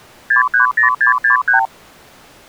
Multi-frequency trunk signalling (R2, with the far end's replies), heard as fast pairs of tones, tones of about 120 ms. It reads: 630663